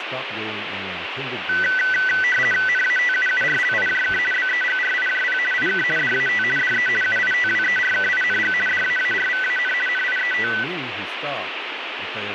RTTY (50 baud, 450 Hz shift), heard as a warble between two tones, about 1750 Hz centre, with radio static and speech in English. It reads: NATUURLIJK BEGRIJP IK DAT DE UITWERKING DAARVAN NIET